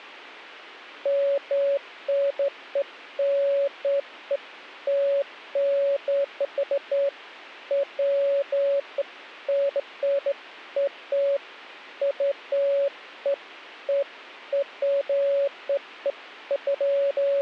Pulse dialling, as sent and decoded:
none

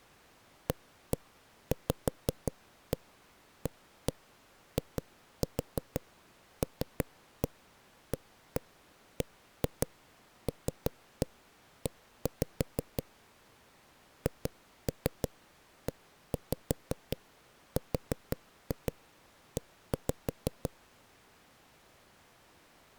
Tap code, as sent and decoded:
1-1 5-1 1-1 2-4 3-1 1-1 1-2 3-1 1-5 / 2-3 1-5 4-2 1-5
AVAILABLE HERE

